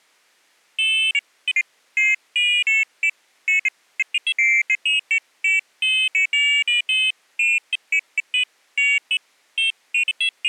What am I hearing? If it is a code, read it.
Pairs of high tones at irregular times. There is no code.